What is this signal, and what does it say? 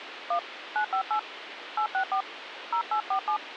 DTMF, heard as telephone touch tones, dialled by hand, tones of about 90 ms, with radio hiss. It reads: 1 958 864 0847